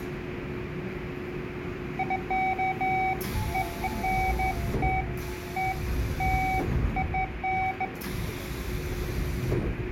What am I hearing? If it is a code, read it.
Beeps of irregular length, with radio static, room echo and the noise inside a subway train. There is no code.